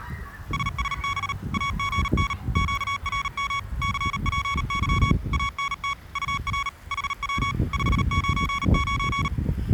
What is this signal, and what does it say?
Morse code, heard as electronic beeps, machine-sent, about 38 wpm, 1120 Hz, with the noise of a residential street. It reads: SSB AGN QRM CPY ANT UR HW 599